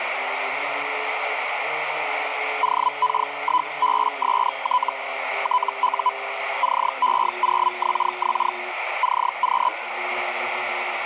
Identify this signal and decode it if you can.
Hellschreiber (Feld-Hell, 122.5 baud), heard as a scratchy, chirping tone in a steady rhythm, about 1000 Hz, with radio static. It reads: OK1BST TU CE0XX CQ